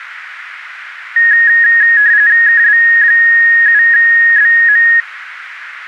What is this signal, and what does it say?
RTTY (45.45 baud, 170 Hz shift), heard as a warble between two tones, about 1750 Hz centre, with radio static. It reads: KB7BM